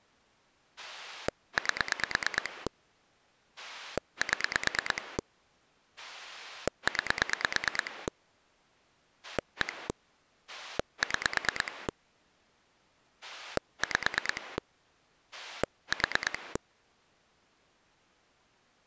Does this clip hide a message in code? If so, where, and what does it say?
Yes: pulse dialling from 0.8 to 16.6 s, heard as a rotary dial, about 9 pulses a second. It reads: 8 7 9 1 6 5 4